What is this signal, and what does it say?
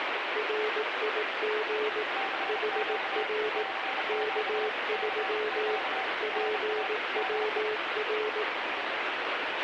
Morse code, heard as two keyed tones, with heavy radio static. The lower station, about 18 wpm, 430 Hz: RIG HR K3 PWR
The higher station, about 31 wpm, 770 Hz: CQ CQ CQ NA DE